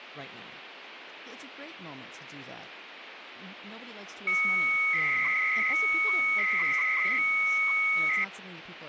300-baud modem data (Bell 103 tones), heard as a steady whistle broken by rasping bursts, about 300 baud, 200 Hz shift, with phone line noise.